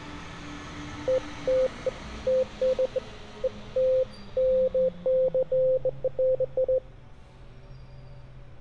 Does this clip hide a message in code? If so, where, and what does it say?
No, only beeps of irregular length, with street noise.